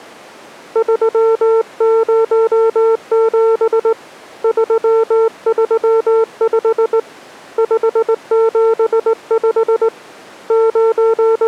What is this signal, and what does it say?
Morse code, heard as a keyed tone, hand-sent with a straight key, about 19 wpm, 450 Hz. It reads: 307 335 575 …